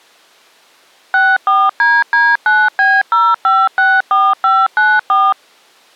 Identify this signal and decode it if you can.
DTMF, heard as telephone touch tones, dialled by machine, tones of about 220 ms. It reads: 64DD9B0564594